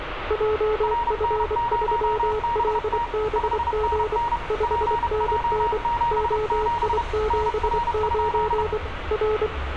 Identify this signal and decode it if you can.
Morse code, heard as two keyed tones, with radio static, room echo and street noise. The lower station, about 24 wpm, 430 Hz: JF3LBG 5NN OI79 R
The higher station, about 31 wpm, 940 Hz: RN0BT 5NN PJ77 NR?